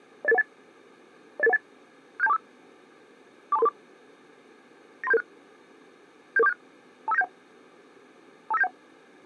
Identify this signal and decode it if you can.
Five-tone selective call (EIA), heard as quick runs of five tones, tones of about 30 ms. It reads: 08818 08818 67245 42334 93776 77476 25971 25971